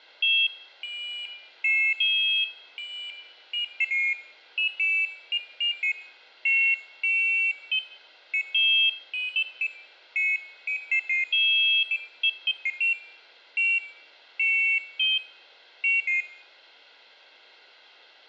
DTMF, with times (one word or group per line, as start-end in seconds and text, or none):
none